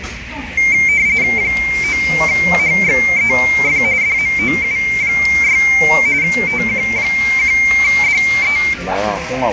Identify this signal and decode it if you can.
RTTY (45.45 baud, 170 Hz shift), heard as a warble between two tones, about 2200 Hz centre, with radio static, a narrow filter and the noise of a restaurant. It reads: 9HXEF DMOU6 TQ1DE